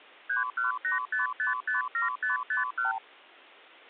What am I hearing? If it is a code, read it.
Multi-frequency trunk signalling (R2, with the far end's replies), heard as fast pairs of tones, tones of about 140 ms. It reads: 3185557551